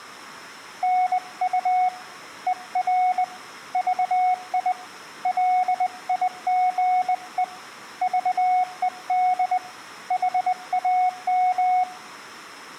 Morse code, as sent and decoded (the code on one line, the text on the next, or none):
-. ..- / . .-. / ...- .. / .-.. .. --. . / ...- . -.. / .... .- --
NU ER VI LIGE VED HAM